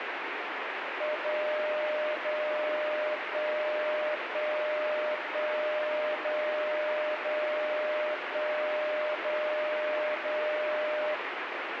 Radio time signal (DCF77), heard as a tone whose level steps once a second, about 610 Hz, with radio static. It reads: 0 0 1 1 1 0 0 1 0 0